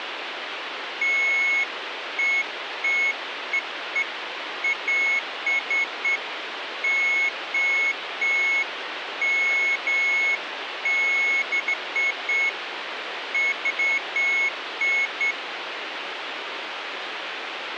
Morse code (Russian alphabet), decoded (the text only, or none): none